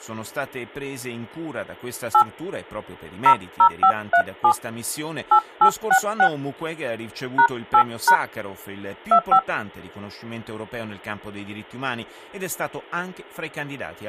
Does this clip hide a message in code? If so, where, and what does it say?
Yes: DTMF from 2.1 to 9.4 s, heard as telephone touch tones, dialled by hand, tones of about 80 ms, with speech in Italian. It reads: 8 00537 8866 #8# 25